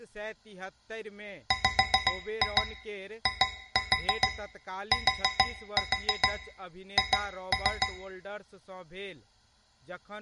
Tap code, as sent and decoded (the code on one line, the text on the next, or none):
5-2 2-4 4-4 2-3
WITH